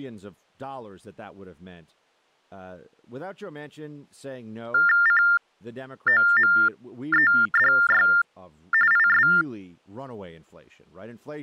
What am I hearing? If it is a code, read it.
TTY/TDD text telephone tones (45.45 baud Baudot), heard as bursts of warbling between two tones, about 400 Hz shift, 1600 Hz centre, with speech in English. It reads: COMEDY IS